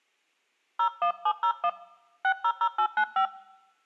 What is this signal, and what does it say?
DTMF, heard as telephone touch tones, dialled by hand, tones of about 80 ms. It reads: 01701 600895